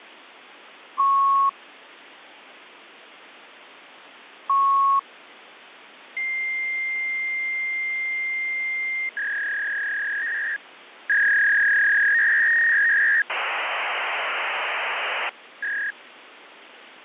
Fax machine handshake, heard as beeps, a long tone, a warble and hiss, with phone line noise.